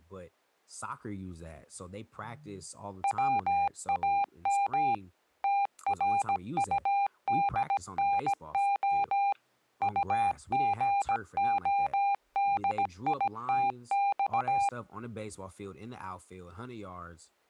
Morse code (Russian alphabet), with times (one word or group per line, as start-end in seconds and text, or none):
3.0-4.9 ВАМ
5.4-9.3 ТРУДНО
9.8-14.7 УГОДИТЬ